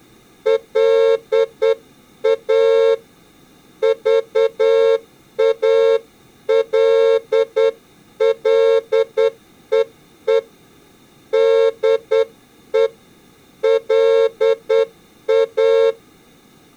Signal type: Morse code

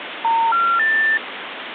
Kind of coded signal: telephone call progress tone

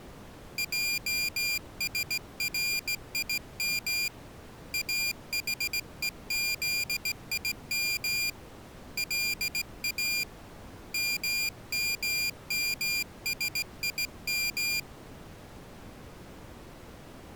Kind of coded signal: Morse code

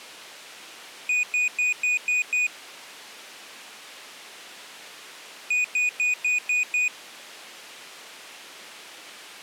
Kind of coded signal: beep code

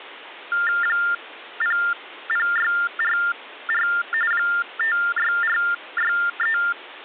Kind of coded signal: TTY/TDD text telephone tones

